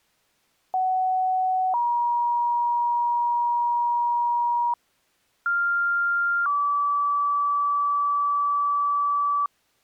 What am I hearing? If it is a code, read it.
Two-tone page, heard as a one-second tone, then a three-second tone, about 750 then 950 Hz, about 1400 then 1150 Hz.